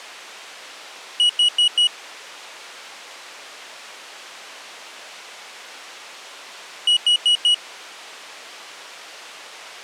Alarm pattern, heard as an alarm's beeps, played twice, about 2900 Hz. Temporal four. Carbon monoxide.